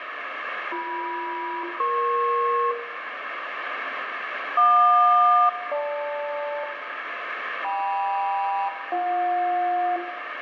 Aircraft SELCAL, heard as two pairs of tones, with radio static and room echo. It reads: BM-EP JQ-GL KM-BJ